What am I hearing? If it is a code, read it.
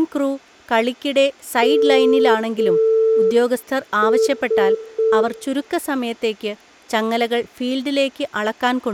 Morse code, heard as a keyed tone, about 5 wpm, 440 Hz, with room echo and speech in Malayalam. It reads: MS